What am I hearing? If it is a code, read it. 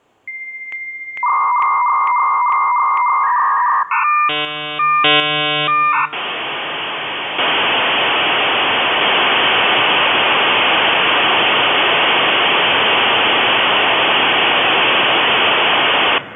Dial-up modem handshake (V.34 or later), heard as a whistle, warbles, then hiss, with room echo.